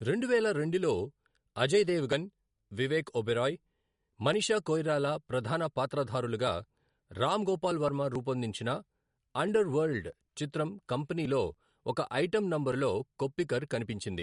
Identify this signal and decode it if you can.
Speech in Telugu. There is no code.